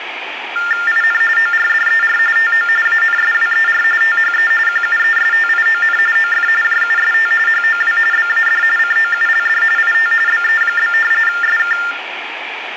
TTY/TDD text telephone tones (45.45 baud Baudot), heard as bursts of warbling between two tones, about 400 Hz shift, 1600 Hz centre, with phone line noise. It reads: IN ORDER TO ANSWER THE QUESTION OF JUST HOW BAD COULD IT BE? SK